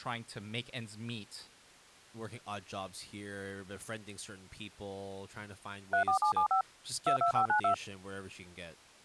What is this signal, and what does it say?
DTMF, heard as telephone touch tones, dialled by machine, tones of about 100 ms, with speech in English. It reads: 34775 22592